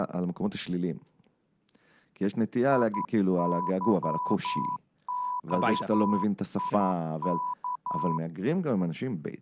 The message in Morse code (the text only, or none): IYOIK